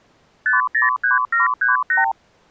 Multi-frequency trunk signalling (R2, with the far end's replies), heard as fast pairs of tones, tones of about 140 ms. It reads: 503738